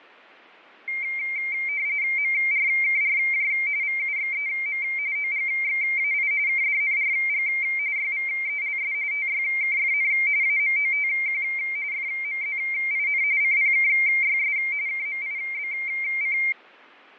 RTTY (45.45 baud, 170 Hz shift), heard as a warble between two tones, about 2200 Hz centre, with fading. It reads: MRKRJ VUXEM OGXAI KDNRG YVELS TYKFN AMOTQ FMZIN CPKYS KMIBC